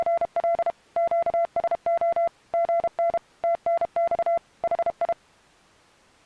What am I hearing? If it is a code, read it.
Morse code, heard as a keyed tone, machine-sent, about 32 wpm, 680 Hz. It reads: … QSO GN TNX HI